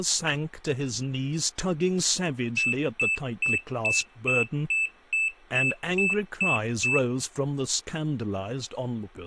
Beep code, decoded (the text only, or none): 11 short